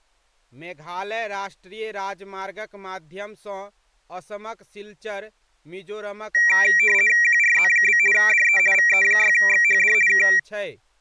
RTTY (50 baud, 450 Hz shift), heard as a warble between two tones, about 2100 Hz centre, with speech in Maithili. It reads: QRZ? DE VE6XHD K